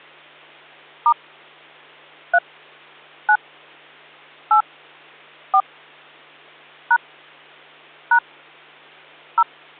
DTMF, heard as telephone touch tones, dialled by hand, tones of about 80 ms, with hum. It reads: * 3 9 8 4 # # 0